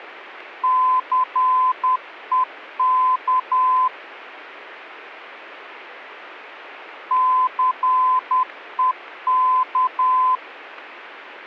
Morse code, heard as a keyed tone, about 10 wpm, 1020 Hz. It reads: CEK CEK